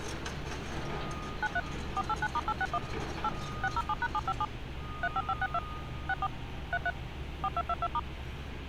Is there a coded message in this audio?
Yes: DTMF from 1.4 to 8.0 s, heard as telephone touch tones, dialled by machine, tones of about 50 ms, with street noise. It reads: 93 489*861 8 607#757 35562 64 33 4222*